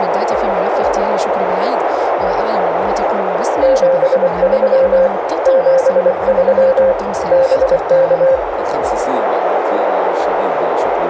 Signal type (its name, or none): Morse code